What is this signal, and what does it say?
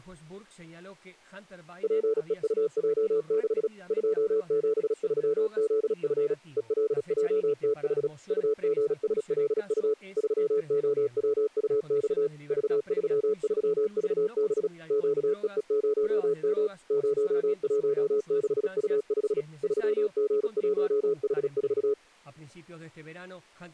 Morse code, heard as a keyed tone, machine-sent, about 36 wpm, 430 Hz. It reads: PEUJ6 273ZF ELJTH UGSLU 3OWUX V33VB QEE0M 016U5 3G1H4